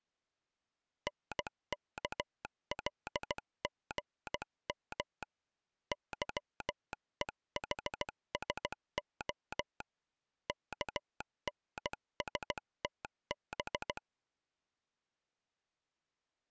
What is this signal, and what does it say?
Morse code, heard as a telegraph sounder, hand-sent with a bug key, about 16 wpm. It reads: NKLGM YEHSO KNSTB